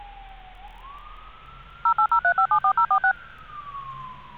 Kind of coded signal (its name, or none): DTMF